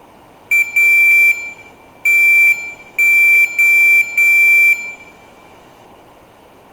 Morse code, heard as a high beeper, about 10 wpm, 2350 Hz, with room echo. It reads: A TO